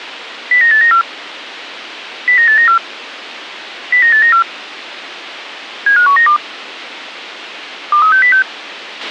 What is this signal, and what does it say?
Five-tone selective call (CCIR), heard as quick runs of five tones, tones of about 100 ms, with radio hiss and a squelch burst at the end. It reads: 09894 09894 09894 75192 23606